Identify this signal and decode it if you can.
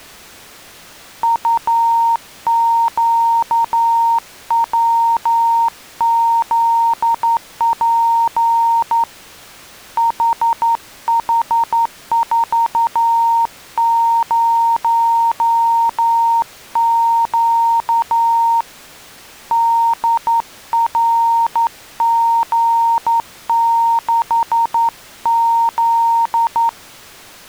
Morse code, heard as a keyed tone, hand-sent with a straight key, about 11 wpm, 920 Hz. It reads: UQWZP HH40Q DRG6Z